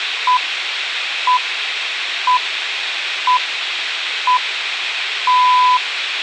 Radio time signal (six pips, as the Greenwich Time Signal), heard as pips, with radio hiss and room echo.